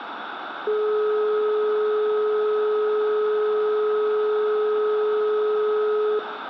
Telephone call progress tone (425 Hz plan, as in most of Europe), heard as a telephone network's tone, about 420 Hz, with phone line noise and room echo. Dial tone.